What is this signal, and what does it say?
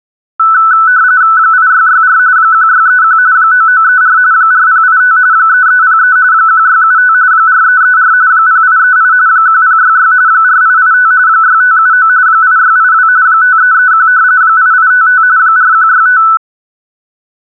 RTTY (45.45 baud, 170 Hz shift), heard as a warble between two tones, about 1400 Hz centre. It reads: 8664 1631 9934 4085 3303 1675 4334 0838 1066 4885 6579 8682 5331 8855 4165